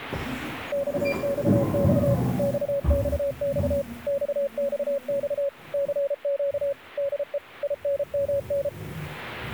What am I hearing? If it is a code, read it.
Morse code, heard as a keyed tone, machine-sent, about 33 wpm, 560 Hz, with the noise inside a lift. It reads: XXX XXX XXX CQ DE INMN